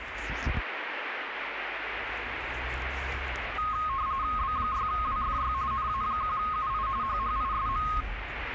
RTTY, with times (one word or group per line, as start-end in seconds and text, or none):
4.4-5.5 B6WFY
5.7-6.9 NA1UI
7.0-7.9 HHISM